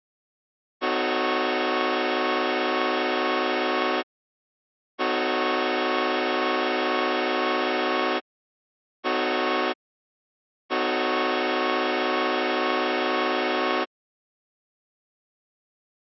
Train horn signal, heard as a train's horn. 2 long, 1 short, 1 long. On North American railways: approaching a public crossing.